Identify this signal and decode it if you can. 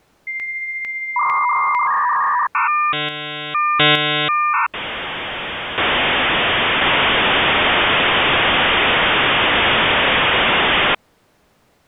Dial-up modem handshake (V.34 or later), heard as a whistle, warbles, then hiss.